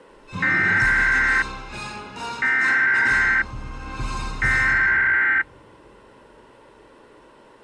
Emergency Alert System (SAME) tones (header bursts), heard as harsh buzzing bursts, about 520.83 baud.